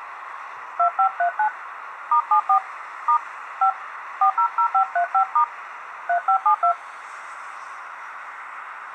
DTMF, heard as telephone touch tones, dialled by hand, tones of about 90 ms, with street noise. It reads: 2539 *74 * 5 400535* 3572